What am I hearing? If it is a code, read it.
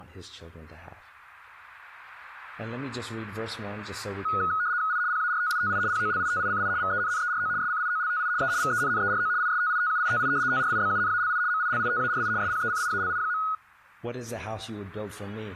RTTY (75 baud, 170 Hz shift), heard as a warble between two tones, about 1360 Hz centre. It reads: I PARTITI POLITICI VENNERO SCIOLTI E VENNERO ISTITUITI TRIBUNALI MILITARI SPECIALI.